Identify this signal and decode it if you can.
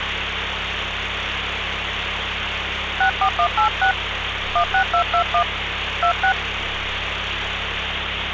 DTMF, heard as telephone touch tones, dialled by hand, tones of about 90 ms, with phone line noise and street noise. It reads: 64186 16221 26